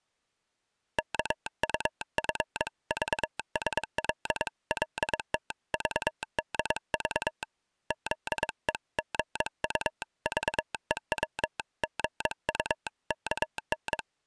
Morse code (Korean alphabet), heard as a telegraph sounder, hand-sent with a paddle, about 22 wpm. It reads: 인력거를 타시랍시요